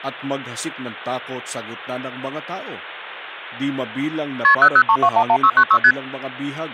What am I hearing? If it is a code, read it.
Multi-frequency trunk signalling (R1, as on North American trunks), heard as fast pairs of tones, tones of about 70 ms, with speech in Filipino. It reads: KP 003211696 ST